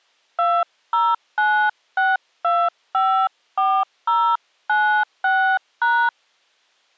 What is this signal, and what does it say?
DTMF, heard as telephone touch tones, dialled by hand, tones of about 270 ms. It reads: 2096254096#